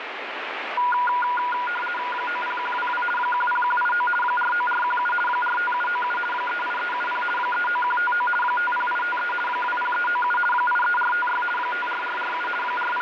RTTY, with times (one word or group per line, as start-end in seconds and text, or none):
2.1-3.0 90122
3.2-4.1 10189
4.2-5.1 49417
5.3-6.2 45797
6.3-7.2 38370
7.4-8.3 39159
8.4-9.3 50853
9.5-10.4 20397
10.5-11.4 83456
11.6-12.5 54447
12.6-13.0 …